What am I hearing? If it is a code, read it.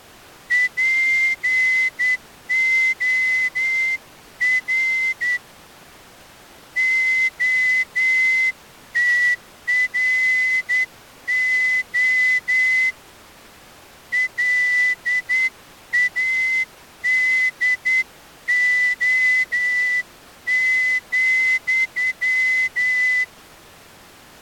Morse code, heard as a whistle, hand-sent with a straight key, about 9 wpm. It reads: POR OTRO LADO,